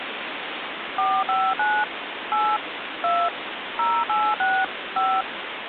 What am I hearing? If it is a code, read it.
DTMF, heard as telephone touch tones, dialled by machine, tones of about 250 ms, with phone line noise. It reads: 459 8 2 086 5